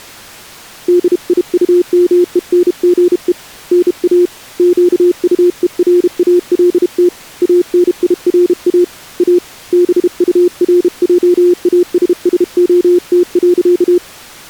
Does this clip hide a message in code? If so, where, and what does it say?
Yes: Morse code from 0.8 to 14.0 s, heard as a keyed tone, hand-sent with a bug key, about 32 wpm, 350 Hz. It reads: DIUMENGE NA QUERALT ANIRA A BURJASSOT.